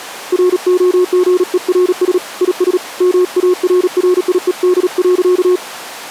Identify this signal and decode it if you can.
Morse code, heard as a keyed tone, hand-sent with a paddle, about 37 wpm, 360 Hz. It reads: ROGERS IS MARRIED.